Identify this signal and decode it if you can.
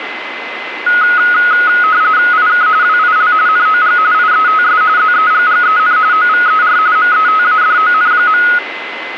RTTY (45.45 baud, 170 Hz shift), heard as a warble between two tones, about 1360 Hz centre, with radio static and a steady whistle near 2040 Hz. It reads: IK WIL NOG IETS ZEGGEN OVER METADON.